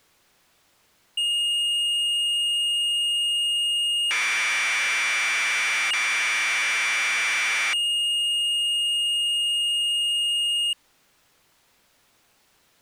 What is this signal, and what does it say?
Commodore tape loading (standard loader), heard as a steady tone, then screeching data.